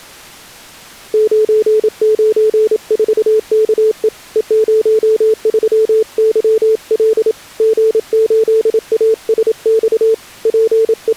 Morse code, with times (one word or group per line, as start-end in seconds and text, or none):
1.1-4.1 994KE
4.4-7.3 E03YL
7.6-10.1 G8ASX
10.5-11.2 …